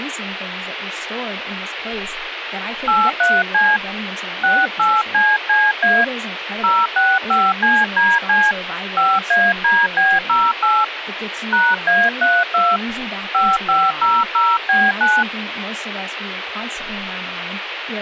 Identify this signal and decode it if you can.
DTMF, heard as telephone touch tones, dialled by hand, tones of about 220 ms, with phone line noise and speech in English. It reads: 83C 68CCA 065CDC 5ADB08 #A32 5500B9